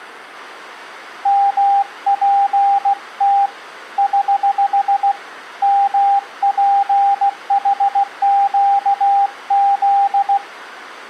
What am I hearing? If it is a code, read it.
Morse code, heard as a keyed tone, hand-sent with a paddle, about 16 wpm, 800 Hz. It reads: MPT <HH> MPHQZ